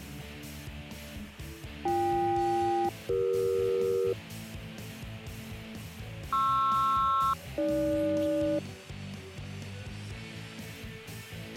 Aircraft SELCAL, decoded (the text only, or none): BK-CE PR-AG